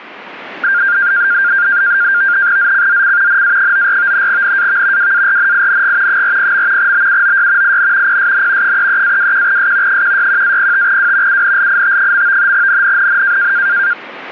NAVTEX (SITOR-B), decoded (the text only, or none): ZCZC NA94 NAV WARNING 40. BUOY IN PSN 33-21S 161-05W UNLIT. NNNN